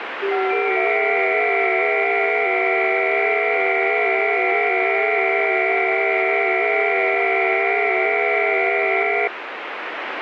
FT8 (several signals at once), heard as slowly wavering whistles, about 6.25 baud, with radio static.